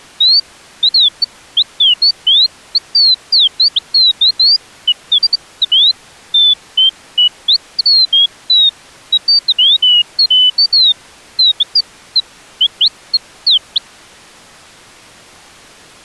Bird-like chirps. There is no code.